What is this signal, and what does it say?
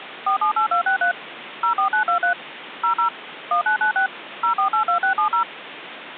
DTMF, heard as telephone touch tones, dialled by machine, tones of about 110 ms, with phone line noise. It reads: 478263 04923 00 1996 0482670